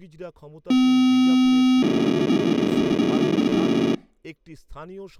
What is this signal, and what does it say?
POCSAG pager data (512 baud), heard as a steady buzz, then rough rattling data, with speech in Bangla.